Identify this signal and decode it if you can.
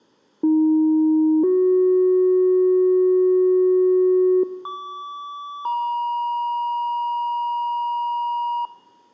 Two-tone page, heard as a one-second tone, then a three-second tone, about 310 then 370 Hz, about 1150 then 950 Hz, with room echo.